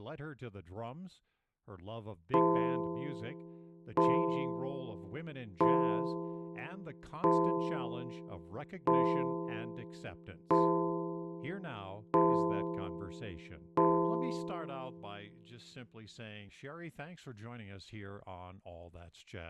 Clock strike, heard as a bell, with speech in English. 8. Eight o'clock.